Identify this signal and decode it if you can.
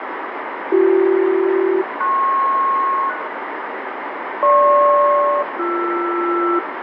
Aircraft SELCAL, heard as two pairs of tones, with radio static. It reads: BC-PS GP-BR